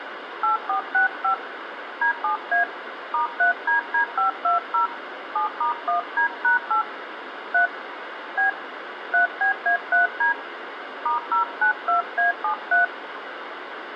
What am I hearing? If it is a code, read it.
DTMF, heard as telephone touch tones, dialled by hand, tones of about 120 ms, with phone line noise and room echo. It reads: 8465 D7A *3DD520 7*1D#8 3 B 3BA3D *092A73